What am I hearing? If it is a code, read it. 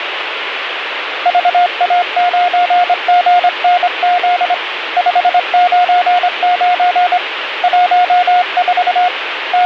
Morse code, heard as a keyed tone, hand-sent with a straight key, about 25 wpm, 720 Hz, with radio static. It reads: VA9GNZ 599 14 …